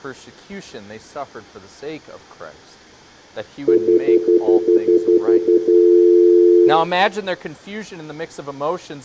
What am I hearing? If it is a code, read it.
Telephone call progress tone (North American plan), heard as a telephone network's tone, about 350, 440 Hz, 0.1 s on and 0.1 s off, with room echo. Stutter dial tone.